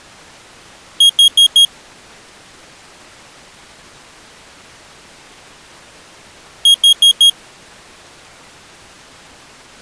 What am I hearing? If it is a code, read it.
Alarm pattern, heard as an alarm's beeps, played twice, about 3250 Hz. Temporal four. Carbon monoxide.